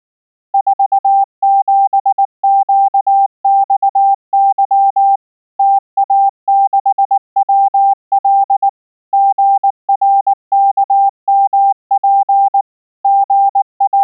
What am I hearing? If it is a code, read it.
Morse code, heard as a keyed tone, machine-sent, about 19 wpm, 790 Hz. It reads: 47QXY TA6WL GRKMP …